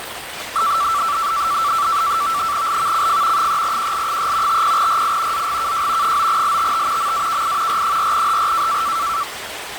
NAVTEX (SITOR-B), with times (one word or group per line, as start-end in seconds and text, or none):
2.7-3.5 LVCF
3.4-4.6 3QL3
4.5-5.5 50RI
5.3-6.2 ZGKJ
6.0-7.1 9LTT
7.0-7.8 MAKI
7.7-8.8 R4HR